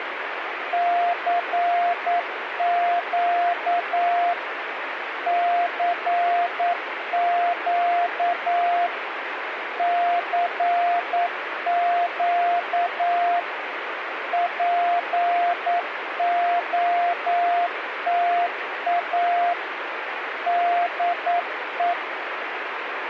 Morse code, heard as a keyed tone, machine-sent, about 9 wpm, 700 Hz, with radio static. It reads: CQ CQ CQ POTA DE